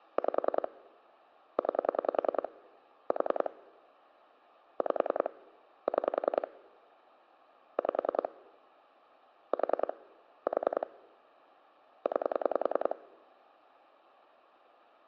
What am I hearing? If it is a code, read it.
Pulse dialling, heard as clicks on a phone line, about 10 pulses a second. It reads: 5 9 4 5 6 5 4 4 9